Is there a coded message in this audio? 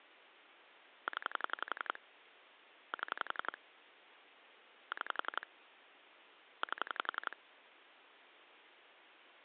Yes: pulse dialling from 1.1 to 7.3 s, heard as clicks on a phone line, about 11 pulses a second. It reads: 0 7 6 8